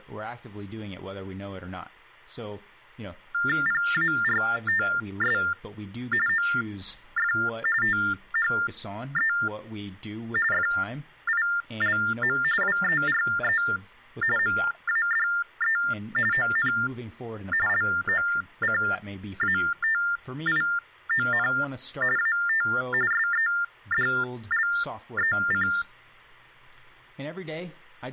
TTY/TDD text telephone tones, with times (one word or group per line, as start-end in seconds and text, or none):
3.7-5.4 PARTS
6.3-7.3 OF
7.8-9.3 THE
10.5-12.4 FILM
12.6-13.6 WERE
14.4-15.8 MADE
16.3-16.7 ON
17.7-21.5 LOCATION
22.2-22.7 AT
23.1-25.7 SEDLEC